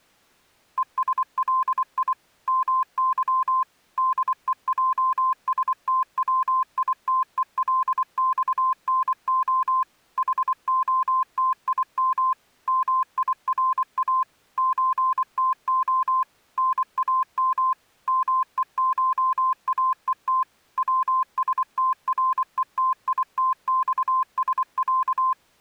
Morse code (Russian alphabet), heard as a keyed tone, machine-sent, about 24 wpm, 1040 Hz. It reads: ЕСЛИ МЫ ДЕЙСТВИТЕЛЬНО ХОТИМ МИРА ЧТО НАМ МЕШАЕТ ВСТРЕТИТЬСЯ